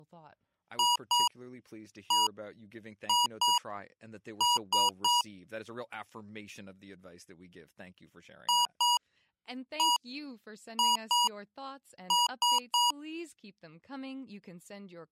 Beep code, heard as beeps from a small speaker, played twice, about 960 Hz, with speech in English. 2-1-2-3. In Phoenix BIOS tables: ROM copyright notice check failure.